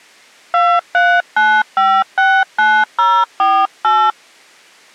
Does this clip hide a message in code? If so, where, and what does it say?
Yes: DTMF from 0.5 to 4.1 s, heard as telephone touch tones, dialled by hand, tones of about 260 ms. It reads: 239569048